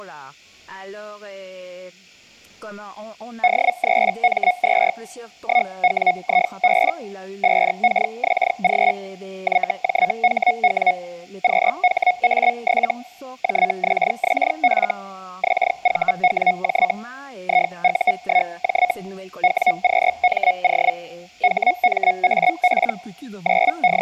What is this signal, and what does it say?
Hellschreiber (Feld-Hell, 122.5 baud), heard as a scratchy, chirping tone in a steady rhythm, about 730 Hz. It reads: D3M2 1WIB 5KXG YJHW QHA7 JXXF XVWJ IU1J WQMO HMAP …